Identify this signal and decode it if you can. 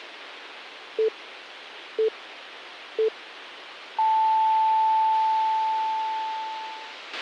Radio time signal (three low pips and a long one an octave up, as on NHK), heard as pips, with a squelch burst at the end.